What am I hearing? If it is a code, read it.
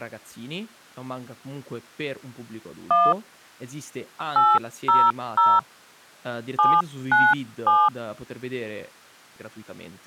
DTMF, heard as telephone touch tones, dialled by hand, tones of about 220 ms, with speech in Italian. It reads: 1 800 797